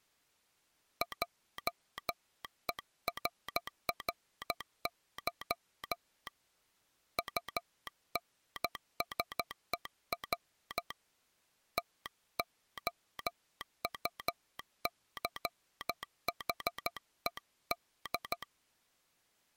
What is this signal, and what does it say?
Morse code, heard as a telegraph sounder, hand-sent with a straight key, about 12 wpm. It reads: JERRY UNSER TOUCHED